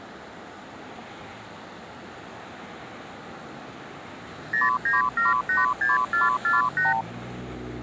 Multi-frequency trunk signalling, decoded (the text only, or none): 09786448